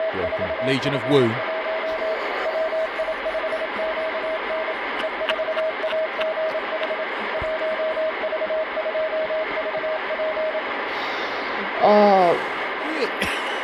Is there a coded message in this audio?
Yes: Morse code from 0.0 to 10.6 s, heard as a keyed tone, machine-sent, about 27 wpm, 640 Hz, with heavy radio static. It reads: … WI5QN E4AGH 1V2VP